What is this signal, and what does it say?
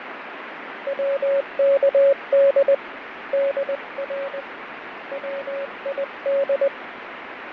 Morse code, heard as a keyed tone, hand-sent with a paddle, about 20 wpm, 550 Hz, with radio static and fading. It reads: WKD DR WID